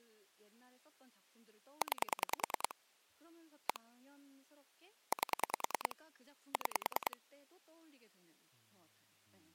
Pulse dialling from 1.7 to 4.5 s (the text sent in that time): 9 1